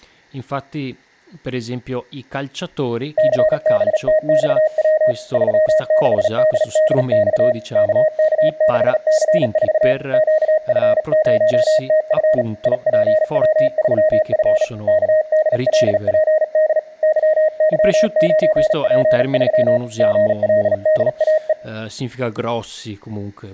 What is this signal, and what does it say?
Morse code, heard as a keyed tone, hand-sent with a bug key, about 37 wpm, 620 Hz, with speech in Italian. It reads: CBTXW 36DDX KK6C4 QF0TF IPW3F KDLPD YY9P3 GLDAE